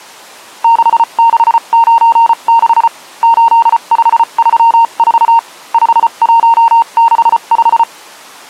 Morse code, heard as a keyed tone, machine-sent, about 34 wpm, spaced as for 29 wpm, 920 Hz. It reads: 6696 8534 5165